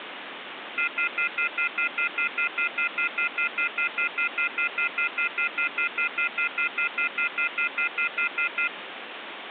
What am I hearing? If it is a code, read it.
Telephone call progress tone (North American plan), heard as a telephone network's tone, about 1400, 2050, 2450, 2600 Hz, 0.1 s on and 0.1 s off, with phone line noise. Off-hook warning tone.